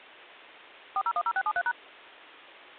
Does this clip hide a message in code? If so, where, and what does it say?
Yes: DTMF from 1.0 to 1.7 s, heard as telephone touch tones, dialled by machine, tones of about 60 ms. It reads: 4010673#